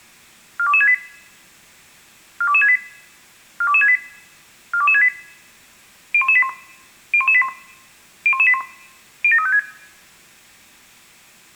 Five-tone selective call (ZVEI), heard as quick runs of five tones, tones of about 70 ms, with room echo. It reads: 42268 42268 42268 42268 01181 01181 01181 07356